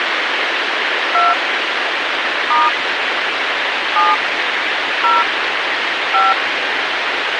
DTMF, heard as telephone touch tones, dialled by hand, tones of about 190 ms, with radio hiss. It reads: 2 * 7 0 5